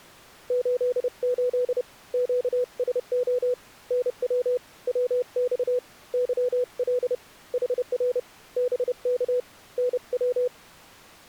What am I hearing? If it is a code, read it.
Morse code, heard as a keyed tone, hand-sent with a paddle, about 30 wpm, 500 Hz. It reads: 88 QSO NW WX YL HR BK NW